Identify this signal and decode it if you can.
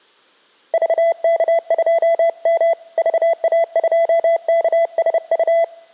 Morse code, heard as a keyed tone, hand-sent with a bug key, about 30 wpm, 670 Hz. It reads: VK2M VA2KSU